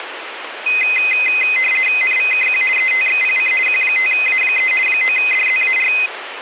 RTTY (50 baud, 450 Hz shift), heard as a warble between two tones, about 2300 Hz centre, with radio static. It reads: NVKQ ETXPC Q5A3 9DZAR